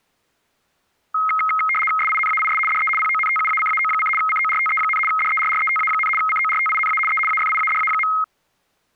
RTTY (75 baud, 850 Hz shift), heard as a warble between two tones, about 1700 Hz centre. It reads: SINAIS DE PONTUACAO: CORTE, DERRETA, CORTINA E AFIADA.